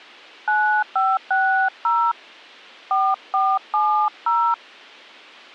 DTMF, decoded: 9560 4470

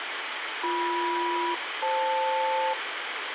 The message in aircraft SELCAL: BM-FL

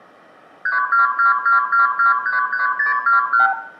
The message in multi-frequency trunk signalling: 32222233621

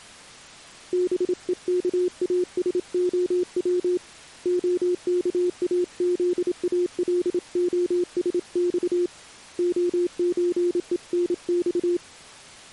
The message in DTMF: none

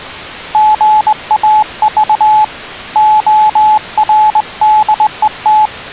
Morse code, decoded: GAV ORDET

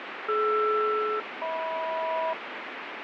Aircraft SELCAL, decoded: DR-HM

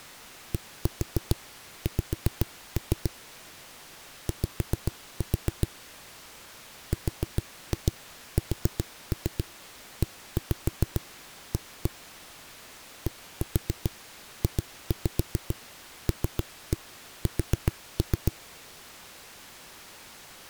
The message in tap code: DX Y RSEA DJLS

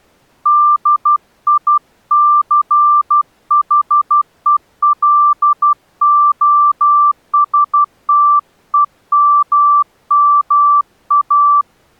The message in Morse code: DICHELOSTEMMA

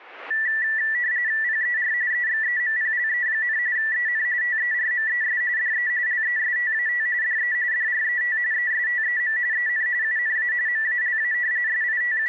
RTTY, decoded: PER EXEMPLE, EN TERMES DE LESTAT DE DRET ESTEM EN UNA MALA …

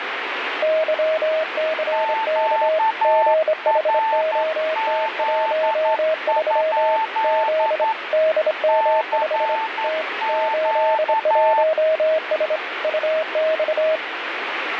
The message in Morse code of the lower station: YCK GHOT13 Z DM5 T 81S UX

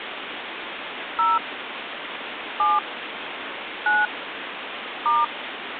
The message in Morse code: none

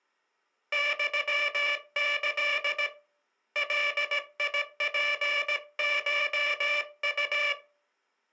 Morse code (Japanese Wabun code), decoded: ユキ ガツコウ

